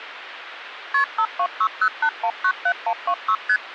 Multi-frequency trunk signalling (R1, as on North American trunks), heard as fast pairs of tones, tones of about 70 ms, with phone line noise. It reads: KP 52608197126 ST